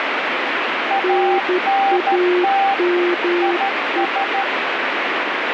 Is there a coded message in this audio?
Yes: Morse code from 0.8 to 4.5 s, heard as two keyed tones, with heavy radio static. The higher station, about 13 wpm, 790 Hz: ANT IS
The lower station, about 12 wpm, 360 Hz: NAME